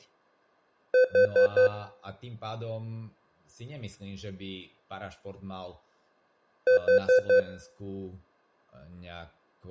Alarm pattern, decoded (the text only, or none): temporal four